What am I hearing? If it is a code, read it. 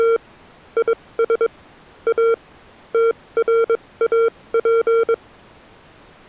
Morse code, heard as electronic beeps, machine-sent, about 22 wpm, spaced as for 18 wpm, 460 Hz. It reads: … IS A TRAP